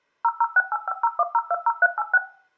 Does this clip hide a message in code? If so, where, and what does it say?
Yes: DTMF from 0.2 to 2.2 s, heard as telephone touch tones, dialled by machine, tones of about 40 ms, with room echo. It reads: 0068501020386